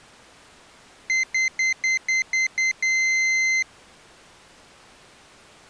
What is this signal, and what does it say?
Beep code, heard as a piezo beeper, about 2050 Hz. 7 short, 1 long.